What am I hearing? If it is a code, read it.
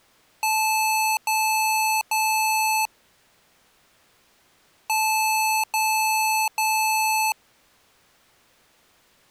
Beep code, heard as beeps from a small speaker, played twice, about 870 Hz. 3 long. In IBM BIOS tables: keyboard card error.